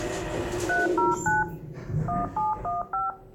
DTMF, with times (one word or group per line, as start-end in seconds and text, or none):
0.7-1.4 309
2.1-3.1 1715